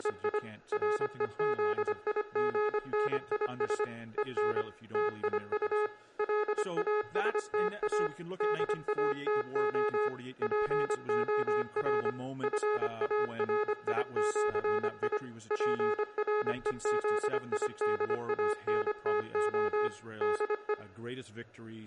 Morse code (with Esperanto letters), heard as electronic beeps, machine-sent, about 25 wpm, 420 Hz. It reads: … REZIGNIS EN TIU LASTA DATO POR FARIĜI PREZIDANTO DE